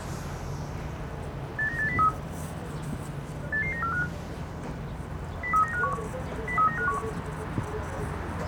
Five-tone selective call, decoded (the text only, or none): 89803 88945 03951 03951